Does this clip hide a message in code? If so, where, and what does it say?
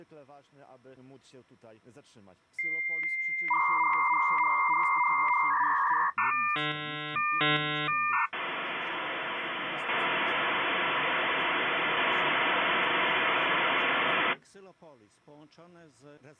Yes: dial-up modem handshake (V.34 or later) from 2.6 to 14.3 s, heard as a whistle, warbles, then hiss.